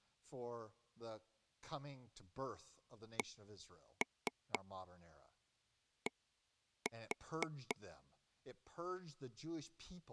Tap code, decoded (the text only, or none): CD